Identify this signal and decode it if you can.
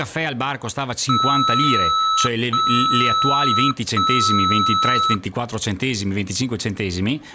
Beep code, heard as beeps from a small speaker, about 1300 Hz, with speech in Italian. 3 long. In IBM BIOS tables: keyboard card error.